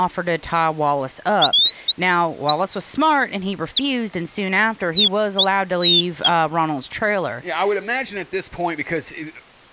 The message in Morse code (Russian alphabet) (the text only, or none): none